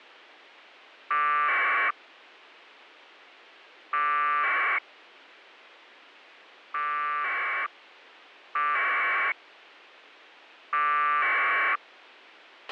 Packet radio (AX.25, as in APRS), 1200 baud, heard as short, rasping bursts, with a squelch burst at the end.